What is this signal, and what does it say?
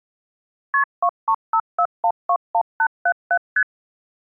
Multi-frequency trunk signalling (R1, as on North American trunks), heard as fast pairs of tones, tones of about 70 ms. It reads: KP 2354121877 ST